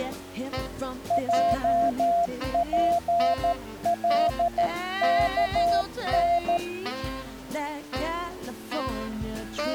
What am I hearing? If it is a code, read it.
Morse code, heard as a keyed tone, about 13 wpm, 690 Hz. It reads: JPLKN